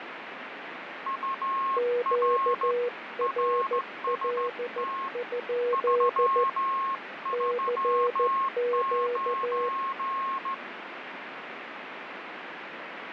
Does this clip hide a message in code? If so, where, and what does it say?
Yes: Morse code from 1.0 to 10.6 s, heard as two keyed tones, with radio static. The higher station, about 15 wpm, 1080 Hz: UR RST 339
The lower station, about 14 wpm, 480 Hz: QRL? CQ